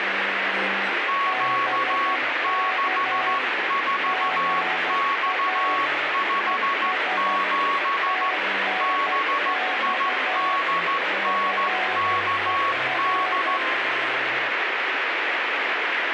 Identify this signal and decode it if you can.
Morse code, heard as two keyed tones, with radio static. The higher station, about 14 wpm, 1110 Hz: Q64X57 BIDNKD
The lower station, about 12 wpm, 750 Hz: BK GA ES TNX FER